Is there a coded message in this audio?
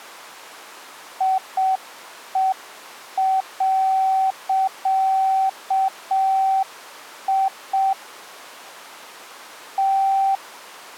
Yes: Morse code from 1.1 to 10.4 s, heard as a keyed tone, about 6 wpm, 770 Hz. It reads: IE.I T